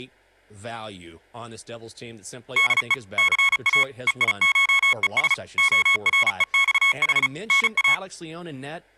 Morse code (Greek alphabet), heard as electronic beeps, machine-sent, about 35 wpm, 1100 Hz, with speech in English. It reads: ΔΕ ΘΑ ΕΙΧΕΣ ΟΡΕΞΗ ΝΑ